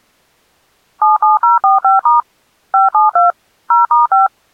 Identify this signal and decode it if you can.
DTMF, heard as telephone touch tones, dialled by machine, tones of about 150 ms. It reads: 77045* 572 0*5